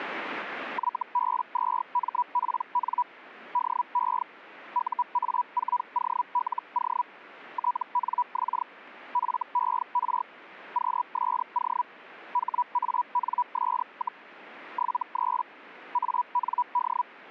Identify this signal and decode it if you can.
Hellschreiber (Feld-Hell, 122.5 baud), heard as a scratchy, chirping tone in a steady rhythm, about 980 Hz. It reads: YB2MPN DE UA4OLO TNX FER QSO HANS, 73 AND